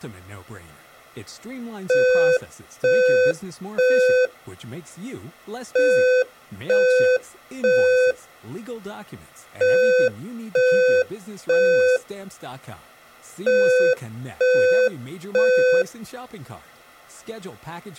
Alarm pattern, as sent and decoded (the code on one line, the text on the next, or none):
3 beeps and a pause
temporal three